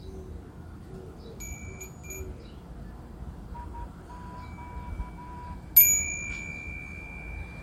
Morse code, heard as a whistle, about 13 wpm, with room echo and the noise of a residential street. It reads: IQ